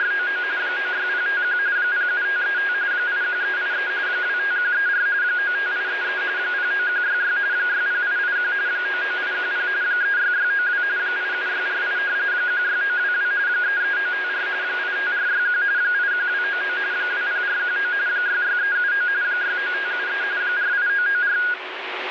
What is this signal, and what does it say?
RTTY (45.45 baud, 170 Hz shift), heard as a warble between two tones, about 1550 Hz centre, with radio static. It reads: … 96051 07535 81383 25134 95833 09166 60881 99810 36692 87648 16922 33954 85461 81299 20419 66379 69573 48994